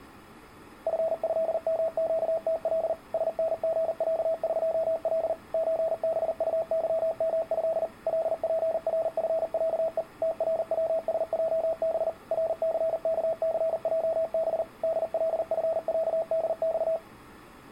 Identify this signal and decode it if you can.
Morse code (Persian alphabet), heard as a keyed tone, machine-sent, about 39 wpm, 650 Hz. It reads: فضمگتل سنژصقل چبطظمض لپرفصه تروسجب رثکثجب دلفصدخ